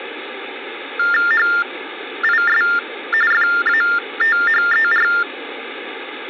TTY/TDD text telephone tones (45.45 baud Baudot), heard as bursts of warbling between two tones, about 400 Hz shift, 1600 Hz centre, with phone line noise. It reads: HIS FATHER